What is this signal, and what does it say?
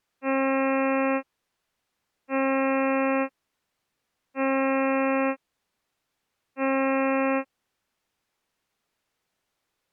Ship horn signal, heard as a ship's horn, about 270 Hz. 4 short. At sea: a pilot vessel's identity signal in fog.